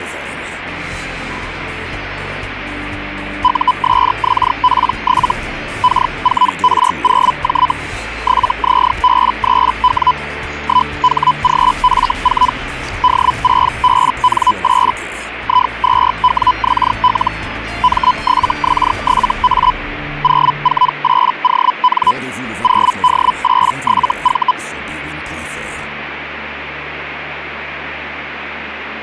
Hellschreiber (Feld-Hell, 122.5 baud), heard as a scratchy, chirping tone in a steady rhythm, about 1000 Hz. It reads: USXP7 K4R0J 7ZB3W 1HGF4 D6BN8 I2WXL M7X7A 048ON 0D87V